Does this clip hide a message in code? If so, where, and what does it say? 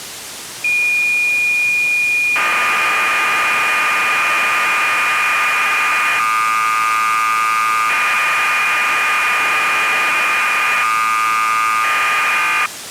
Yes: cassette data (Kansas City type), 1200 baud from 0.6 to 12.7 s, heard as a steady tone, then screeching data.